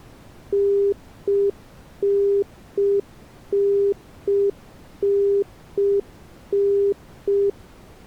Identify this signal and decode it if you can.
Telephone call progress tone (UK plan), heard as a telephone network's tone, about 400 Hz. Congestion tone.